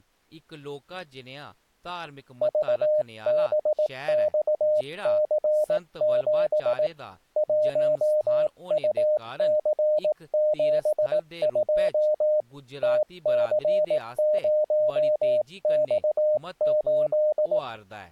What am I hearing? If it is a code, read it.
Morse code, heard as a keyed tone, hand-sent with a paddle, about 18 wpm, 610 Hz, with speech in Dogri. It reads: VBXC7 1UC72 TC0X8